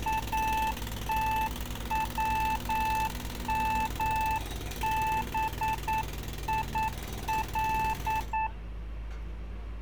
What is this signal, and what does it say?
Morse code (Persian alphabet), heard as a keyed tone, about 9 wpm, 880 Hz, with street noise. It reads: اتومبیل